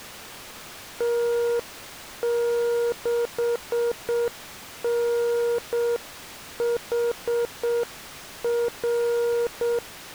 Morse code, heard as a keyed tone, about 7 wpm, 470 Hz. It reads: T6NHR